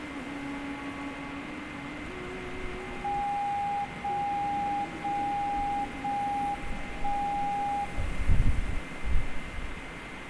Radio time signal (JJY), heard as a tone whose level steps once a second, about 810 Hz, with radio static and a steady whistle near 2080 Hz. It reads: 0 0 0 1 0